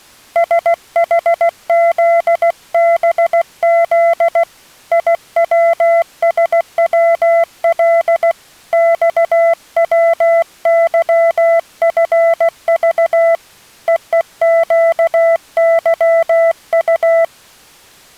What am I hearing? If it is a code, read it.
Morse code, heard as a keyed tone, hand-sent with a paddle, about 16 wpm, 670 Hz. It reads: SHZBZ IWSWL XWYFV EEQYU